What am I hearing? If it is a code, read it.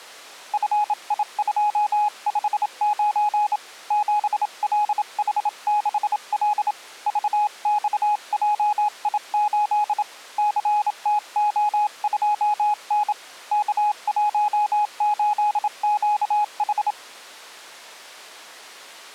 Morse code, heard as a keyed tone, hand-sent with a bug key, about 27 wpm, 840 Hz. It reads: FI259 7LH6L VXJI8 CTO2N K18QH